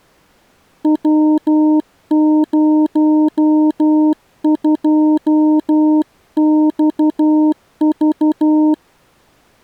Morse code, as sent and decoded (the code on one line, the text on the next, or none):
.-- ----- ..--- -..- ...-
W02XV